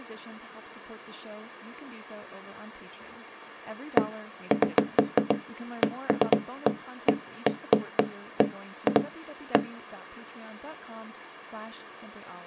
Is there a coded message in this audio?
No, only irregular knocks on wood, with speech in English.